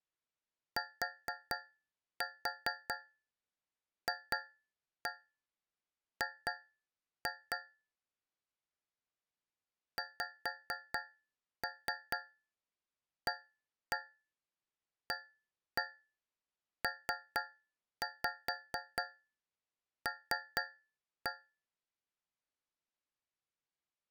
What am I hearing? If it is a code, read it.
Tap code, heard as taps on a metal pipe, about 4 knocks a second. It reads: TFG XAAPL